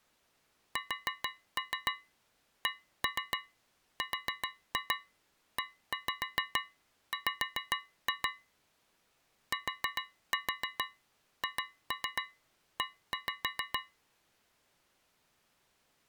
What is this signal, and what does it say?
Tap code, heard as taps on a metal pipe, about 7 knocks a second. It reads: SCREW THE